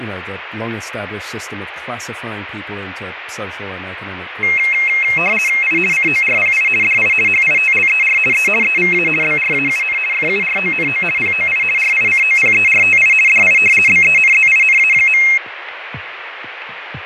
RTTY (50 baud, 450 Hz shift), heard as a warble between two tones, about 2350 Hz centre, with radio static and fading. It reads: I CORPI DI HITLER E EVA BRAUN FURONO POI RICOPERTI DI BENZINA.